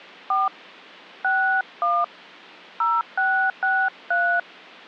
DTMF, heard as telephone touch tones, dialled by hand, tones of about 260 ms. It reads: 4 61 0663